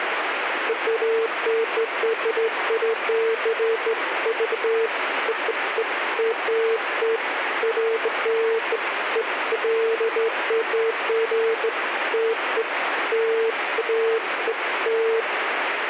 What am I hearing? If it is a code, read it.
Beeps of irregular length, with radio static. There is no code.